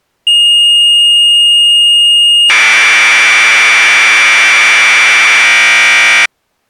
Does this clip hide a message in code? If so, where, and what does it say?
Yes: Commodore tape loading (standard loader) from 0.3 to 6.3 s, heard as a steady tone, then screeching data.